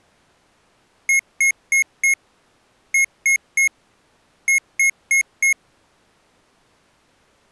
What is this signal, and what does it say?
Beep code, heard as beeps from a small speaker, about 2150 Hz. 4-3-4. In Phoenix BIOS tables: time-of-day clock failure.